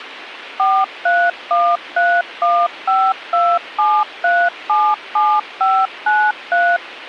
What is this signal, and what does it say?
DTMF, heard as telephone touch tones, dialled by machine, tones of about 250 ms, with radio hiss. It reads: 43131527377593